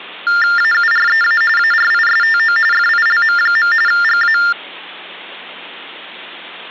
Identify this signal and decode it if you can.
TTY/TDD text telephone tones (45.45 baud Baudot), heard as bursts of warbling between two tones, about 400 Hz shift, 1600 Hz centre. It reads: AUREA ARISTO FILM. GA